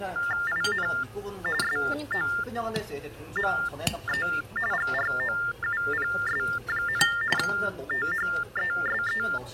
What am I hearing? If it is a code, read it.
TTY/TDD text telephone tones (45.45 baud Baudot), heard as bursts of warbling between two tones, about 400 Hz shift, 1600 Hz centre, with the noise of a restaurant. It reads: IN SOME GROUPS, THESE